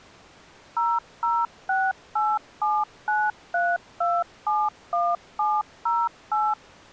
DTMF, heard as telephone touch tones, dialled by machine, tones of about 220 ms. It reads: 0068793271708